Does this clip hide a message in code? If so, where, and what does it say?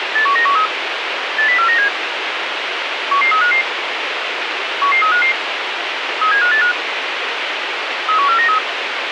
Yes: five-tone selective call (CCIR) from 0.2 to 8.6 s, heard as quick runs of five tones, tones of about 100 ms, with radio hiss. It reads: 81913 80497 11355 11355 37585 31493